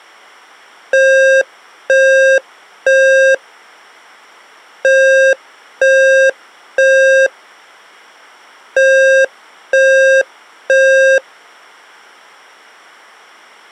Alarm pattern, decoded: temporal three

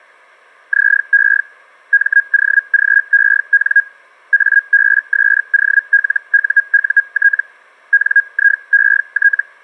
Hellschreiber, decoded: ZE MOGEN ABSOLUUT NIET

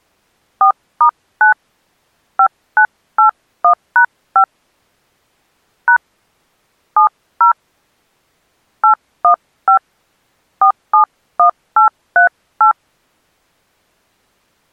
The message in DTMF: 4*9 5981#5 # 70 815 471838

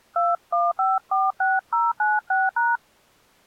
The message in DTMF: 21546096#

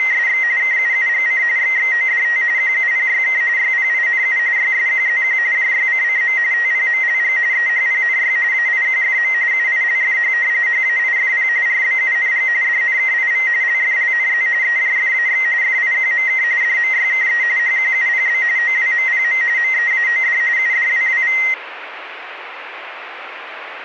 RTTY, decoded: … KUUGC XXODT QUPYK YPINU YSQZQ JYCCM TPMLG EHPNY AIQFM UILFH HAIFP RBUNG DNKIV LFLNZ EJFAX FIQMK DMYKE HQUPB OWMPM MEAOD UDWWV

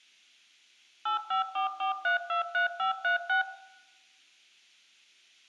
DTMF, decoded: 8544323536

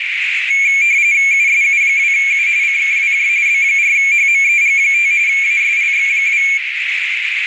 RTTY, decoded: USU2U CKWJ B4HMEG5 ASLX2

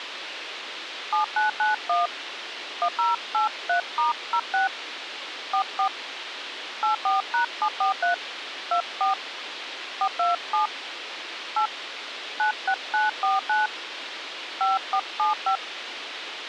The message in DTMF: 7991 1083*06 44 84#743 24 427 8 96949 5475

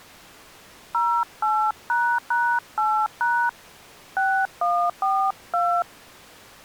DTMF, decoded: 08##8# 6142

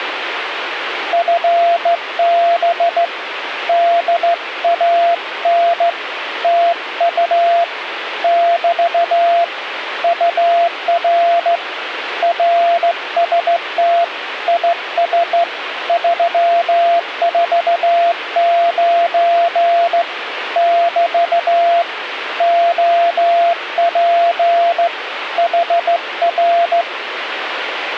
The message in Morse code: FB DAN TU <BT> UR RST IS 349 <BT> OP HR

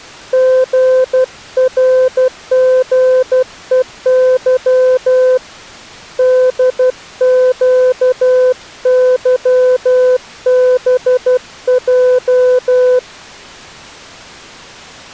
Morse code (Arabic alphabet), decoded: غرغءظ دقظبج

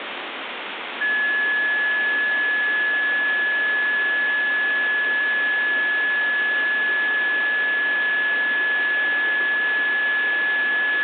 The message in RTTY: none

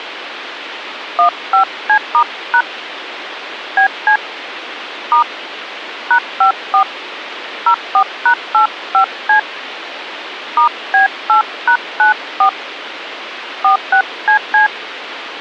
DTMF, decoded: 15C*# BC * #54 04#85C *B8#94 46CC

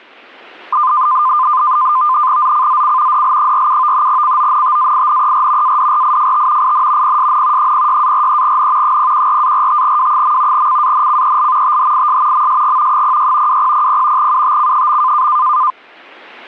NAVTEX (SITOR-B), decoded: ZCZC DL47 CONTAINER ADRIFT IN PSN 06-43N 014-45W. CANCEL THIS MSG 06 2000 UTC.

